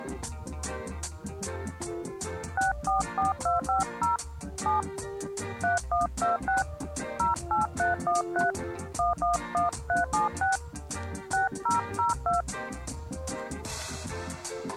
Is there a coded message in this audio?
Yes: DTMF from 2.6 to 12.4 s, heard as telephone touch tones, dialled by hand, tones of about 140 ms. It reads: 644250 7 3126 08313 111376 6002